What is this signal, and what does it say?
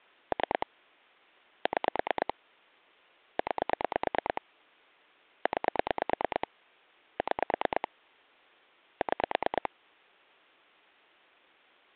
Pulse dialling, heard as clicks on a phone line, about 9 pulses a second. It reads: 3 6 9 9 6 6